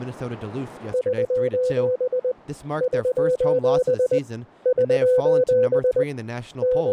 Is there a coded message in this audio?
Yes: Morse code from 0.9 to 6.9 s, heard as a keyed tone, hand-sent with a paddle, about 20 wpm, 500 Hz, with speech in English. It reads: <SOS> <SOS> <SOS> …